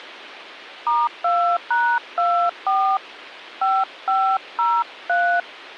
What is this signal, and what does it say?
DTMF, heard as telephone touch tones, dialled by hand, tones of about 240 ms. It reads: *2#24 5503